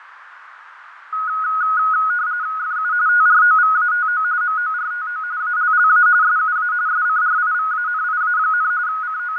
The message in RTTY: FU TROVATO MORTO ALLA SUA SCRIVANIA, …

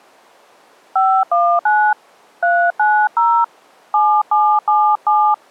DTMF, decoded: 519 390 7777

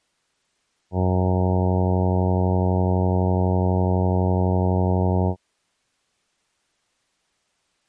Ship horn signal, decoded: 1 long

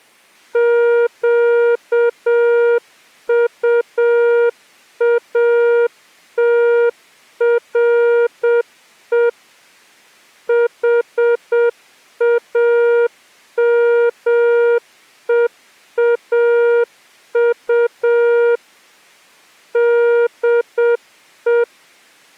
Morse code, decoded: QUATRE HAMEAU DE

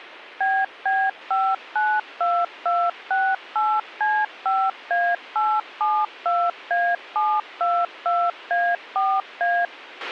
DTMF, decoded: BB592268C5A872A722A4A

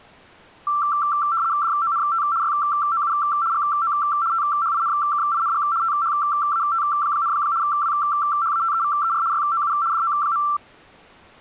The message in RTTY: DONT YOU GO THINKING THAT, WHATEVER YOU DO.

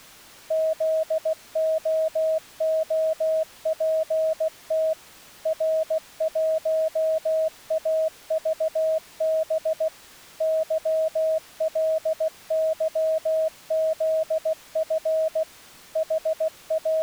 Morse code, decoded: ZOOPT R1AVB YLYZF …

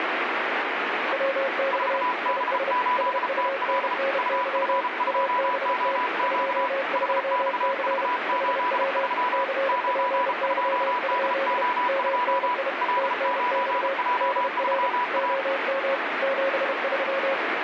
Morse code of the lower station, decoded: WX IS SUNNY ABT 22C HW CPY? MNI TNX DR OM 73

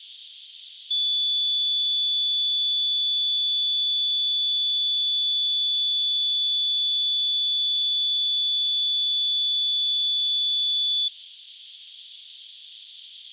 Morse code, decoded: none

